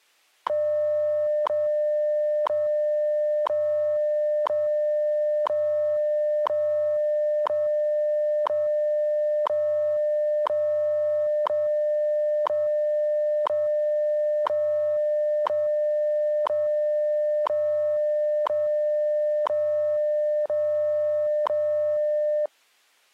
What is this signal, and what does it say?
Radio time signal (WWV, Colorado), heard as ticks, one a second.